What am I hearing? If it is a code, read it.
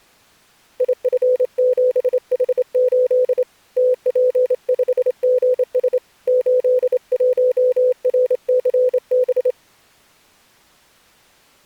Morse code, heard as a keyed tone, hand-sent with a straight key, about 27 wpm, 500 Hz. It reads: IF7H8 TP5GS 81RCB